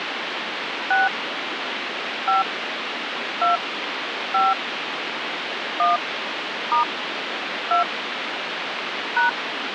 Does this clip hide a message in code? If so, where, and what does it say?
Yes: DTMF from 0.9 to 9.3 s, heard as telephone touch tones, dialled by hand, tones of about 140 ms, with phone line noise. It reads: 6 5 2 5 1 * 2 #